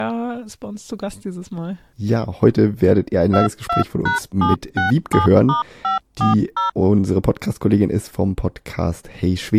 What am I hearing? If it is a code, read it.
DTMF, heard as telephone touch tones, dialled by machine, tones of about 130 ms, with speech in German. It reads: 22#767*540